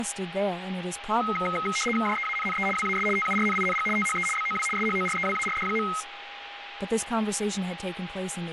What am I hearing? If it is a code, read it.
RTTY (75 baud, 850 Hz shift), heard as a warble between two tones, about 1700 Hz centre, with radio static, a steady whistle near 810 Hz and speech in English. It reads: JEANNE WAS TURNING THE BOW SHOREWARD.